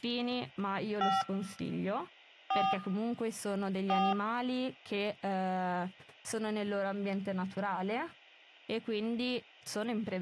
DTMF, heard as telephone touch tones, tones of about 200 ms, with speech in Italian. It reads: 5 4 4